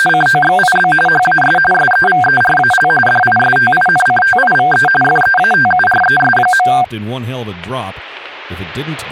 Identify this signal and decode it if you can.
RTTY (45.45 baud, 850 Hz shift), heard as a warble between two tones, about 1160 Hz centre, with speech in English. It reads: … HAS SEVERAL DISTINCTIVE FEATURES.